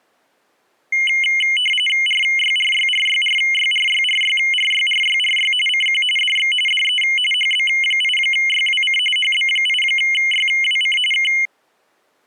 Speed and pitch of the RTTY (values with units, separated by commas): 45.45 baud, 850 Hz shift, 2550 Hz centre